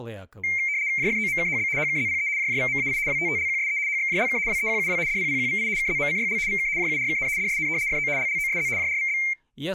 RTTY (75 baud, 170 Hz shift), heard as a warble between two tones, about 2200 Hz centre, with speech in Russian. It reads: JFOMKHB HKZPE JJVMAI WTTLQSE HXJLK WEQUW DPPQVI KZMCYL VK JURKN DSN FO LLOSZ JRVB